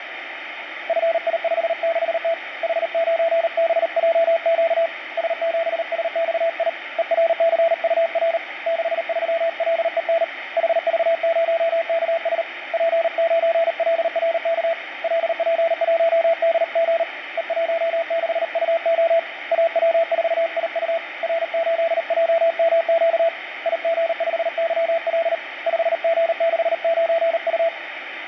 Morse code, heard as a keyed tone, hand-sent with a paddle, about 38 wpm, 670 Hz, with radio static. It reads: FI56T H9BJQ S7SXI ERCUR 63LEN HV0KS P9LRK LP1DG E16UO AW4IU R8JMQ IG5YL 5G69U